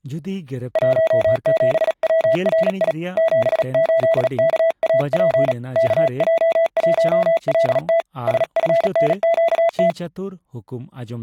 Morse code, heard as a keyed tone, hand-sent with a paddle, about 37 wpm, 660 Hz, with speech in Santali. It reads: 17WRI 78KAP KJ1LT SFNQT